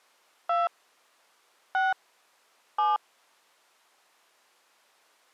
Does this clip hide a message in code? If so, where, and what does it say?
Yes: DTMF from 0.5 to 3.0 s, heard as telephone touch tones, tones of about 180 ms. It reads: 2 6 7